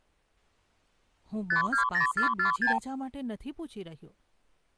Multi-frequency trunk signalling (R2, with the far end's replies), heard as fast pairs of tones, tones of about 110 ms, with speech in Gujarati. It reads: 520446